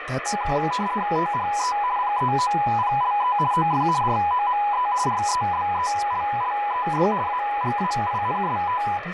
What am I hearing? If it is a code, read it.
RTTY (50 baud, 170 Hz shift), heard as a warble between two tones, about 910 Hz centre, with radio static and speech in English. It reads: THE PEOPLE OF ROME REBELLED AGAINST